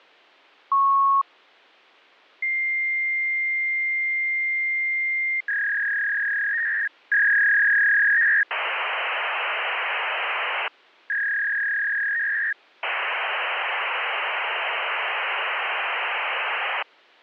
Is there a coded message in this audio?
Yes: fax machine handshake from 0.7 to 16.8 s, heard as a beep, a long tone, a warble and hiss.